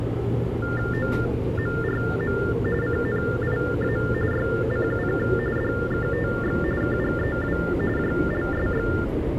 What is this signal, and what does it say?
TTY/TDD text telephone tones (45.45 baud Baudot), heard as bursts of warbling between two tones, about 400 Hz shift, 1600 Hz centre, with phone line noise and the noise inside a subway train. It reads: OMRM CNIA YCUK DKTX KGEW JLSX